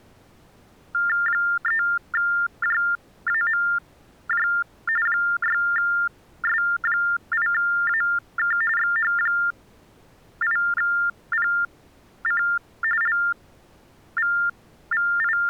TTY/TDD text telephone tones (45.45 baud Baudot), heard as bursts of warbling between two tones, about 400 Hz shift, 1600 Hz centre. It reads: 3JAMJ 6S8AK XH8PC …